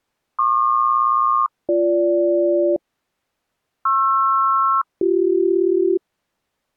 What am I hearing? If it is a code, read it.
Aircraft SELCAL, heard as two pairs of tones. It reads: PQ-BG PR-BC